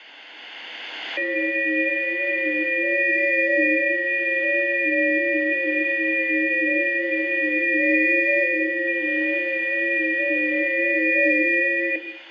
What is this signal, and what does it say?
FT8 (several signals at once), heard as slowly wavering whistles, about 6.25 baud, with room echo.